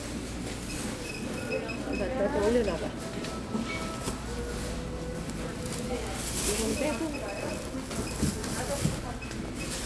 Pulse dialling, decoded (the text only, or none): none